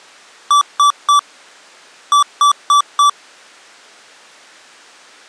Beep code, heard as beeps from a small speaker, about 1160 Hz. 3-4.